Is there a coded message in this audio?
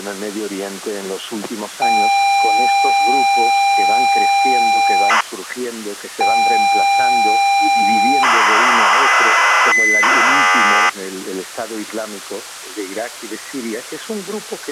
Yes: ZX Spectrum tape loading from 1.8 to 10.9 s, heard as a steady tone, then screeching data.